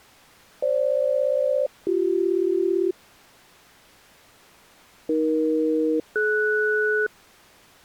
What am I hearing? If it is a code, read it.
Aircraft SELCAL, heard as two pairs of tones. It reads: FG-BC AE-DS